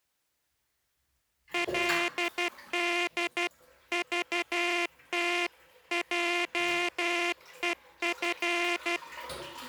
Morse code (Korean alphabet), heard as a buzzer, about 12 wpm, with the noise of a restroom. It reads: 그러한